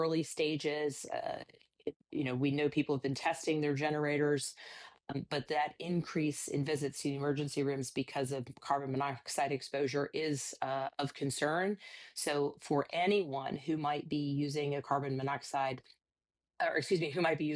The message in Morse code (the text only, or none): none